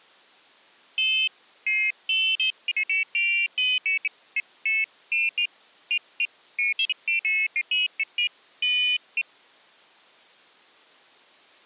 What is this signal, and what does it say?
Pairs of high tones at irregular times. There is no code.